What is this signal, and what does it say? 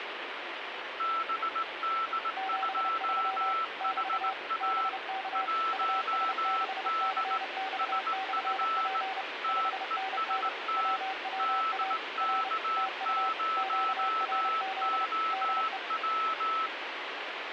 Morse code, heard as two keyed tones, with radio static. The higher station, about 19 wpm, 1320 Hz: BD2HA 1D SF TEST DK0OW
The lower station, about 30 wpm, 770 Hz: 73 <BT> BK US6CX/P 5NN WWA R TU QRZ DE